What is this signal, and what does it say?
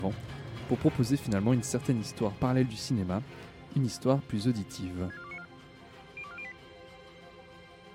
Five-tone selective call (ZVEI), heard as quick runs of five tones, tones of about 70 ms. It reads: 64294 02408